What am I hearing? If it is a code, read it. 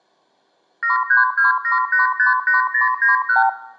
Multi-frequency trunk signalling (R2, with the far end's replies), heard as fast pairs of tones, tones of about 140 ms, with room echo. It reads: 7327858091